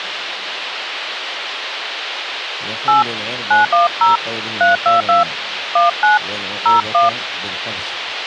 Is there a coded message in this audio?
Yes: DTMF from 2.9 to 7.1 s, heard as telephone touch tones, dialled by hand, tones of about 150 ms, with radio hiss. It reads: 8 910 322 19 01